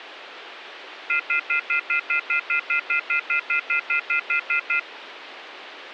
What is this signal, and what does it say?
Telephone call progress tone (North American plan), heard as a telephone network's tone, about 1400, 2050, 2450, 2600 Hz, 0.1 s on and 0.1 s off, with phone line noise. Off-hook warning tone.